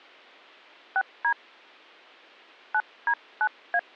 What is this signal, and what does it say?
DTMF, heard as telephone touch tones, dialled by hand, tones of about 70 ms. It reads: 6D 9D9A